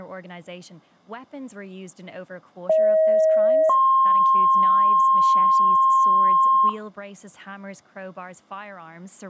Two-tone page, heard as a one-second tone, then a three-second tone, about 630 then 1060 Hz, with room echo and speech in English.